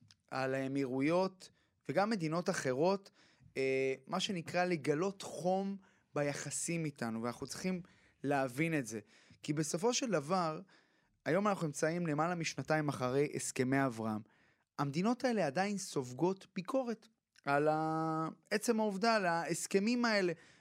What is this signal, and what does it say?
Speech in Hebrew. There is no code.